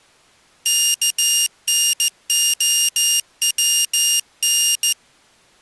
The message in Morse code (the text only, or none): KNOWN